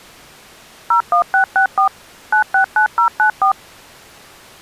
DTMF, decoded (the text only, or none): 01664 969094